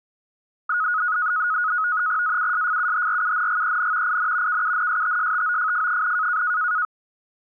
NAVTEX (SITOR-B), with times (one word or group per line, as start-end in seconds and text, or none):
2.2-4.2 AUSFUHRUNGEN
4.1-4.6 IN
4.5-6.4 KUNSTSTOFF,